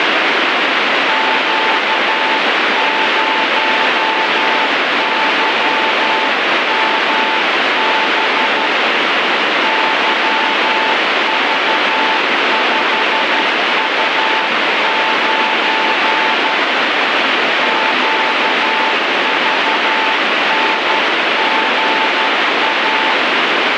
Morse code, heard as a keyed tone, hand-sent with a paddle, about 12 wpm, 880 Hz, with heavy radio static. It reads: Q0YMB YV5U9 QVNGA